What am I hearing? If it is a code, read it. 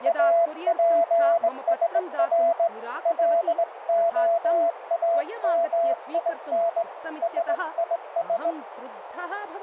Morse code (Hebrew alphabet), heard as a keyed tone, hand-sent with a straight key, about 19 wpm, 680 Hz, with radio static, a narrow filter and speech in Sanskrit. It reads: אפשר להאמין שיש